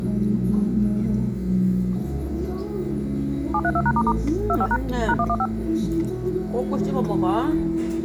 DTMF, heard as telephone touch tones, dialled by machine, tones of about 60 ms, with the noise of a restaurant. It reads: 732#** 25# #115